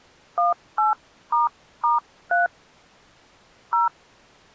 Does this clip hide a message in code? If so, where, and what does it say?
Yes: DTMF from 0.4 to 3.9 s, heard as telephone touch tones, dialled by hand, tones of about 150 ms. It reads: 18**3 0